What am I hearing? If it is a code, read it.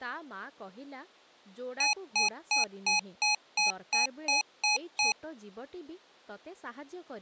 Beep code, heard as beeps from a small speaker, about 840 Hz, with speech in Odia. 10 short. In AMI BIOS tables: CMOS shutdown register error.